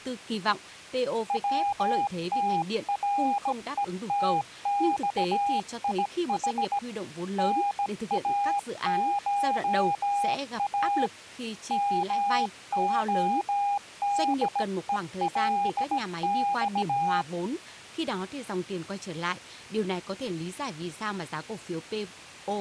Morse code (Russian alphabet), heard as a keyed tone, hand-sent with a bug key, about 17 wpm, 810 Hz, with speech in Vietnamese. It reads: ВТРЕТЬИХ НАША МОДЕЛЬ